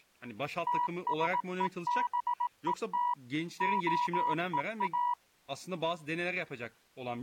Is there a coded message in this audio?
Yes: Morse code (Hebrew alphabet) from 0.6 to 5.2 s, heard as a keyed tone, machine-sent, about 18 wpm, 970 Hz, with speech in Turkish. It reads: תשובות הוא